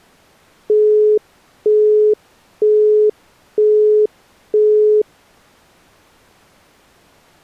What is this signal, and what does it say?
Telephone call progress tone (single-tone plan, as in Europe, Japan and elsewhere), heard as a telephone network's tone, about 420 Hz, 0.48 s on and 0.48 s off. Busy tone.